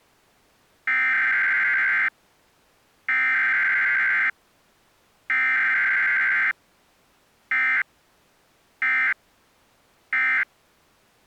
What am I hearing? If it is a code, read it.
Emergency Alert System (SAME) tones (header bursts, then end-of-message bursts), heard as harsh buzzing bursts, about 520.83 baud.